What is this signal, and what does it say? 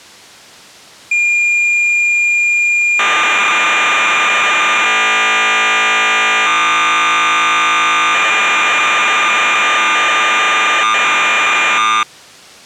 Cassette data (Kansas City type), 1200 baud, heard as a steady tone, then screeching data.